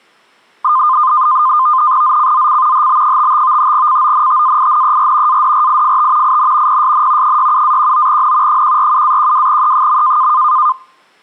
NAVTEX (SITOR-B), 100 baud, 170 Hz shift, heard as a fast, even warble, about 1130 Hz centre. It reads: ZCZC HB55 CONTAINER ADRIFT IN PSN 67-19N 147-12E.